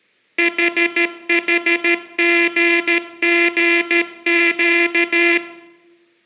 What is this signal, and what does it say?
Morse code, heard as a buzzer, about 13 wpm, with room echo. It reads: HHGGQ